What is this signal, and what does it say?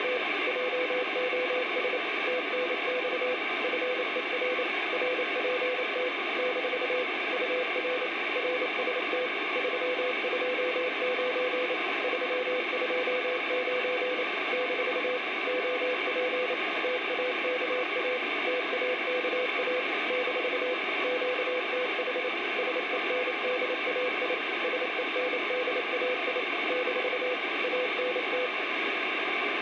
Morse code, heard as a keyed tone, machine-sent, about 28 wpm, 500 Hz, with radio static and room echo. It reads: … JOS TNX FER RPT - UR RST 329 329 - OP TAKA TAKA - QTH SENDAI SENDAI - ANT